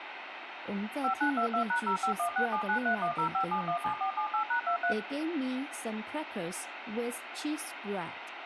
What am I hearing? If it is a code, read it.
DTMF, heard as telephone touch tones, dialled by machine, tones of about 100 ms, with radio hiss, a squelch burst at the end, room echo and speech in Chinese. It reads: 5922#0516793105717478#23